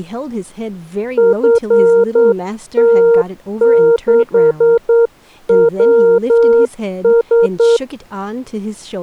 Morse code, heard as a keyed tone, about 9 wpm, 460 Hz, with speech in English. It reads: FT6WS